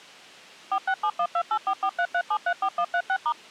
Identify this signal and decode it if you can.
DTMF, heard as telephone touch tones, dialled by machine, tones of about 70 ms. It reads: 4671284433734136*